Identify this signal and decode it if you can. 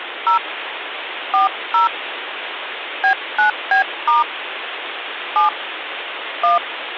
DTMF, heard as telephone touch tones, dialled by hand, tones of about 120 ms, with phone line noise. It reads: 0 40 B9B* 7 1